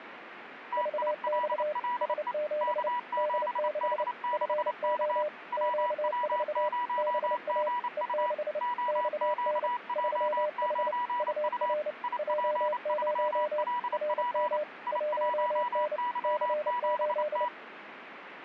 Morse code, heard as two keyed tones, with radio static. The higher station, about 28 wpm, 980 Hz: TILLE K7D6K WW0GU OQJ9U IP3LP I1Y7T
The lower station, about 29 wpm, 600 Hz: VX S7 D6 FO Q4 BA E6 XN 3H UR J0 RM 1N C8